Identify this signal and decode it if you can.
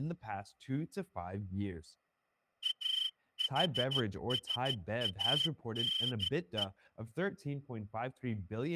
Morse code (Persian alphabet), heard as a whistle, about 14 wpm, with speech in English. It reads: احسانه